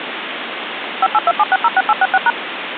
DTMF, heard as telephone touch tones, dialled by machine, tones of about 40 ms, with phone line noise. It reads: 5827606866#